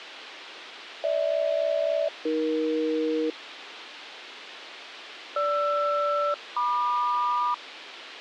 Aircraft SELCAL, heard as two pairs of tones, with radio hiss and a squelch burst at the end. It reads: GH-AE GR-MQ